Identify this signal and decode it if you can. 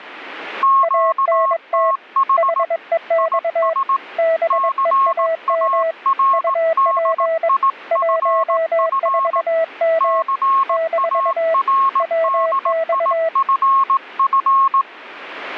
Morse code, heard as two keyed tones, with radio static. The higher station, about 18 wpm, 1080 Hz: QTH IS CARDIFF CARDIFF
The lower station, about 22 wpm, 650 Hz: ANT HEX BEAM UP 14M - WX